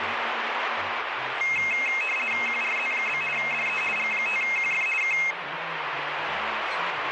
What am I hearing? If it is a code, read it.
RTTY (50 baud, 450 Hz shift), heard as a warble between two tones, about 2350 Hz centre, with radio static. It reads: QRZ? DE G5QF K